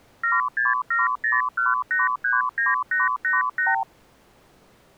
Multi-frequency trunk signalling (R2, with the far end's replies), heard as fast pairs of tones, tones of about 170 ms. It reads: 76701839888